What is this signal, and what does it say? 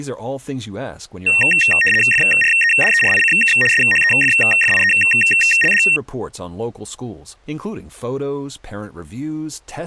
RTTY (75 baud, 850 Hz shift), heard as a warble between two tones, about 2300 Hz centre. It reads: FREDERICK SHEFFIELD